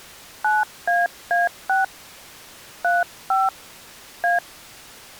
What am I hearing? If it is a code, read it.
DTMF, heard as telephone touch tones, dialled by hand, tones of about 170 ms. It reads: 9AA6 35 A